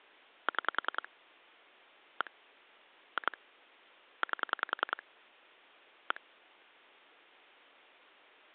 Pulse dialling, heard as clicks on a phone line, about 10 pulses a second. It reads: 6 1 2 8 1